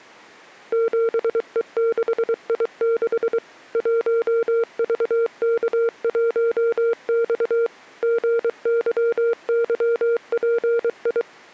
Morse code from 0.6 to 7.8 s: 7E6I6 1VK1X

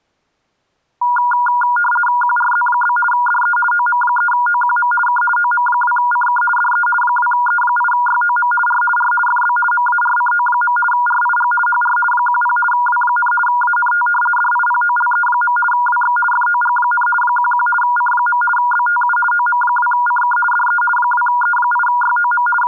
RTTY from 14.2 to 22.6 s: DIPOLE. WX FOG, 11 C. BTU OM2CK DE 2E8YOM …

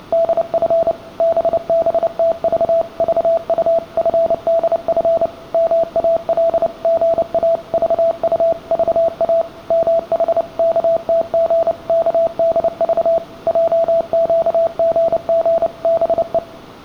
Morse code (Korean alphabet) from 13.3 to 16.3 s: 했다

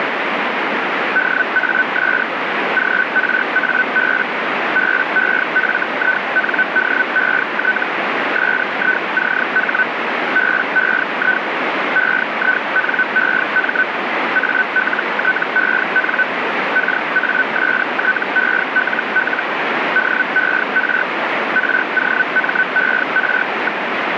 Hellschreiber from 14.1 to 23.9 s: ALTEN KASTELL DER ROMER.

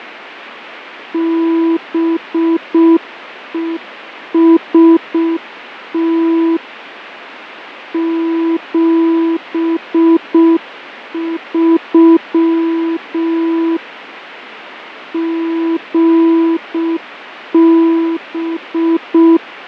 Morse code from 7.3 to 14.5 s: 73

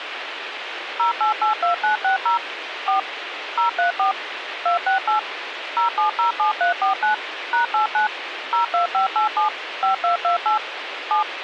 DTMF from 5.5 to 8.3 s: 0707349 #89

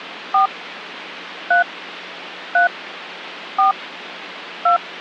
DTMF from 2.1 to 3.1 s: 3

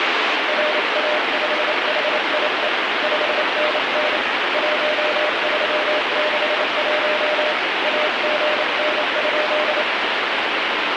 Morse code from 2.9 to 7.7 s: 5NN 1361

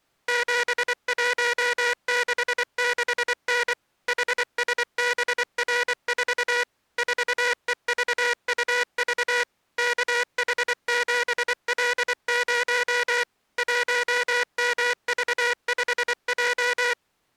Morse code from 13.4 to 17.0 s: 1MV5J

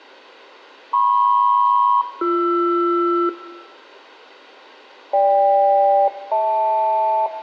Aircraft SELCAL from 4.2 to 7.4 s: GK-HL

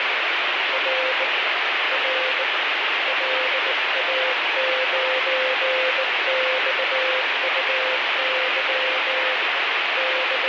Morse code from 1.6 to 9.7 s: R LA9XUY

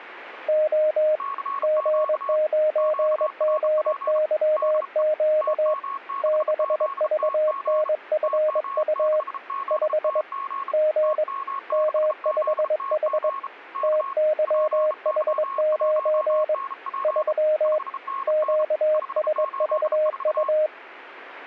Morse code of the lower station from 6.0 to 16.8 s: 6VNFU 5 G M5H TYH9

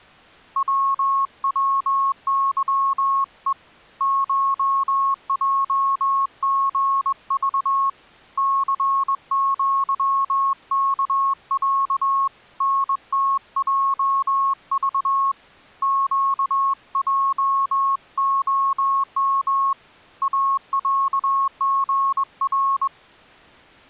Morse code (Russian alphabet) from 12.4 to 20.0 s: НТЙЖ ЩЙОМ

